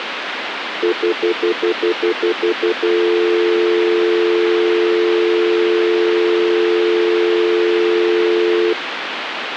Telephone call progress tone (North American plan), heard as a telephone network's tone, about 350, 440 Hz, 0.1 s on and 0.1 s off, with phone line noise. Stutter dial tone.